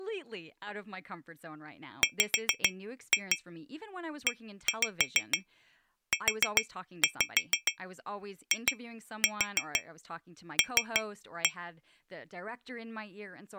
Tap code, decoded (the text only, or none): WEUIL